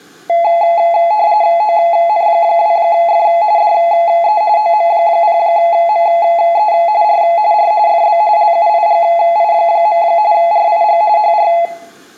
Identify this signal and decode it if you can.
RTTY (45.45 baud, 170 Hz shift), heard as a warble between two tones, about 770 Hz centre, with room echo. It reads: ON2F DE OM0ME R R FB LUIGI. RIG HR